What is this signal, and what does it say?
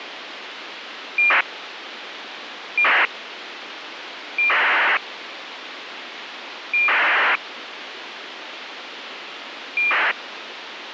ACARS aircraft data, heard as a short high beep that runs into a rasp, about 2400 baud, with radio hiss.